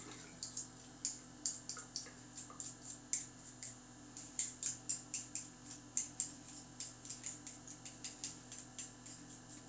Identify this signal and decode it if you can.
The noise of a restroom. There is no code.